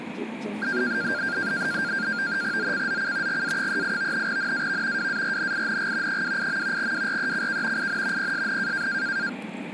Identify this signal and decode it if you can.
NAVTEX (SITOR-B), 100 baud, 170 Hz shift, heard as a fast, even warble, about 1500 Hz centre, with radio static and the noise inside a car. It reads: ZCZC GA38 NAV WARNING 28. WRECK IN PSN